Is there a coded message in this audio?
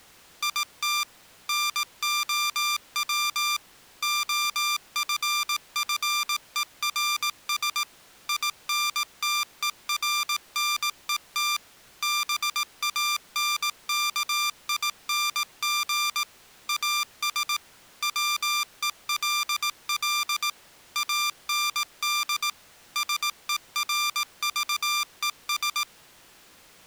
Yes: Morse code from 0.4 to 25.9 s, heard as electronic beeps, machine-sent, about 18 wpm, 1190 Hz. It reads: IT NOW OFFERS INTERNET BANKING AS WELL AND SERVES